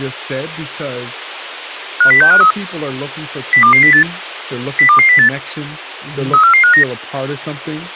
Five-tone selective call (CCIR), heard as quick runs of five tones, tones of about 100 ms, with speech in English. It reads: 50653 02208 02208 34459